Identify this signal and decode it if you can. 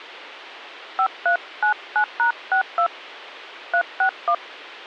DTMF, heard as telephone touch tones, dialled by hand, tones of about 90 ms. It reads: 5399#62 361